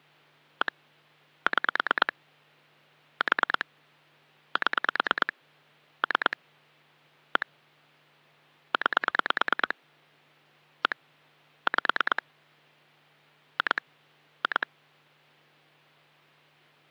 Pulse dialling, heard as clicks on a phone line, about 9 pulses a second, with hum. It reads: 1 6 4 7 3 1 9 1 5 2 2